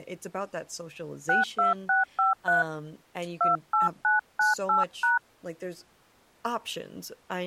DTMF, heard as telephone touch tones, dialled by hand, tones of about 150 ms, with speech in English. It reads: 62653 28998#